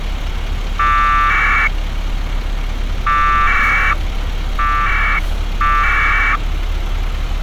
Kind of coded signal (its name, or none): packet radio (AX.25, as in APRS)